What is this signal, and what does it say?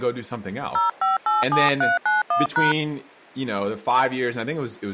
DTMF, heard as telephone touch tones, dialled by hand, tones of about 140 ms, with speech in English. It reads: 0587391#